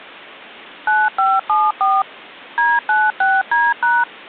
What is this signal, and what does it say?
DTMF, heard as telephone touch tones, dialled by machine, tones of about 210 ms. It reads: 9574 D96D#